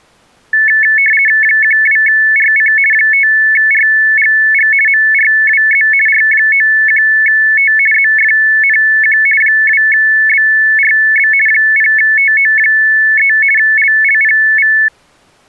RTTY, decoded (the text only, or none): 12RC 5RGG MRWZ R91T ZFNQ 2BRB 0TO3 LLPV